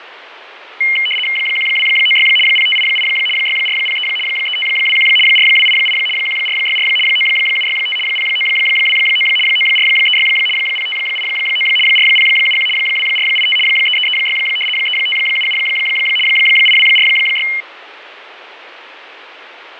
RTTY (75 baud, 850 Hz shift), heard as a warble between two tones, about 2550 Hz centre, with radio static and fading. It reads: 1296 0588 6403 3521 4288 1464 9765 0929 9436 0589 4071 2485 3336 3577 8246